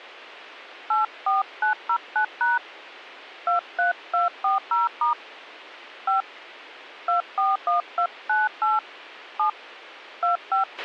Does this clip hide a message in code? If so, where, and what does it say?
Yes: DTMF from 0.9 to 10.6 s, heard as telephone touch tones, dialled by hand, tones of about 130 ms, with a squelch burst at the end. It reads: 84909# 23240* 5 241298 7 25